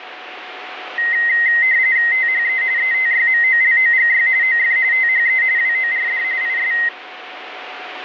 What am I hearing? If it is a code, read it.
RTTY (45.45 baud, 170 Hz shift), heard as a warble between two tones, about 1950 Hz centre, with radio static and a steady whistle near 740 Hz. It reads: THE ETYMOLOGY OF THE WORD IS